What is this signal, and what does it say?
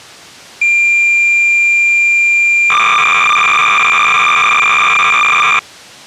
Cassette data (Kansas City type), 300 baud, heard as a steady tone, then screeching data.